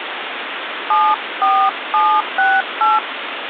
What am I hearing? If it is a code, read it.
DTMF, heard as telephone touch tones, dialled by hand, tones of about 230 ms, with phone line noise. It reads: 74768